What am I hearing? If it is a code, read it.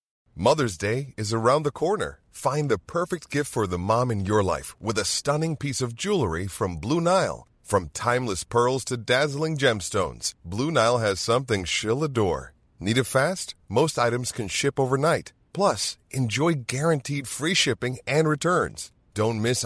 Speech in English. There is no code.